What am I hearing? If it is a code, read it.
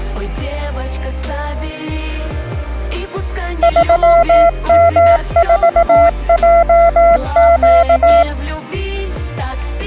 Morse code, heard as a keyed tone, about 18 wpm, 680 Hz. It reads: 3M4JQ